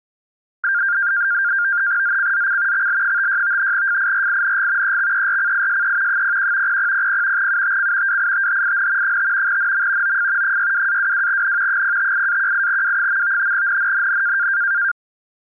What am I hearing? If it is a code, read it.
NAVTEX (SITOR-B), 100 baud, 170 Hz shift, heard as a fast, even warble, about 1500 Hz centre. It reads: ZCZC XL56 FIRING EXERCISE 01 0000 UTC WITHIN 5 NM OF 62-22N 058-18W. NNNN